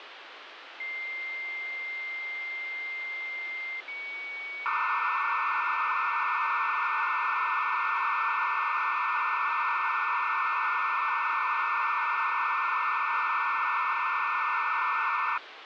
Dial-up modem handshake (low-speed, two carriers), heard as two whistles, then hiss, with phone line noise.